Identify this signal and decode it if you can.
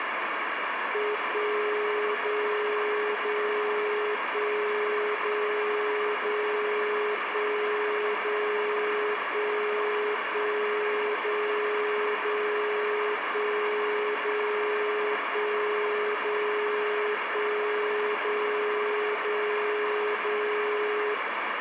Radio time signal (DCF77), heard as a tone whose level steps once a second, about 420 Hz, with radio static. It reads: 1 0 0 1 0 0 1 0 1 1 0 0 1 0 1 0 1 0 0 0